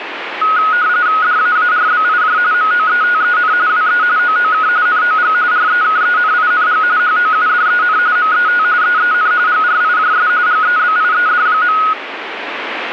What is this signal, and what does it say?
RTTY (45.45 baud, 170 Hz shift), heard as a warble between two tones, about 1360 Hz centre, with radio static. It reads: DAARBIJ MOETEN WE OOK NOG REKENING HOUDEN MET EEN GRIJS GEBIED.